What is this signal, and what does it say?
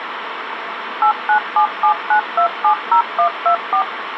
DTMF, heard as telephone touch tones, dialled by machine, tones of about 90 ms, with phone line noise. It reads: 89779270124